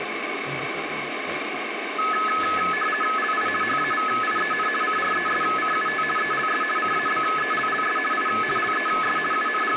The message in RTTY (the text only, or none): LI HAVIEN CRESCUT ELS CABELLS I LES …